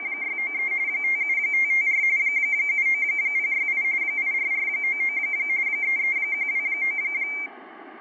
RTTY (45.45 baud, 170 Hz shift), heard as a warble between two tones, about 2200 Hz centre, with fading. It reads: … 57554 79068 84499 33129